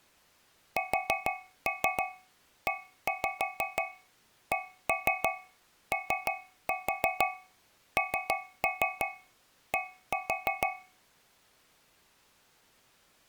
Tap code, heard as taps on a metal pipe, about 6 knocks a second. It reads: SECOND